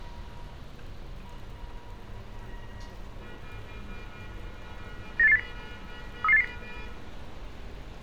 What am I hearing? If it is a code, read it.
Five-tone selective call (EEA), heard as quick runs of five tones, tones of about 40 ms, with street noise. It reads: 98880 33880